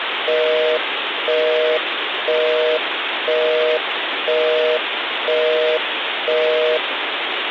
Telephone call progress tone (North American plan), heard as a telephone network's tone, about 480, 620 Hz, 0.5 s on and 0.5 s off, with phone line noise. Busy tone.